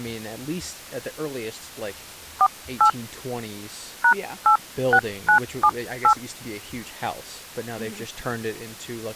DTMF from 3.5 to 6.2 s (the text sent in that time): #86978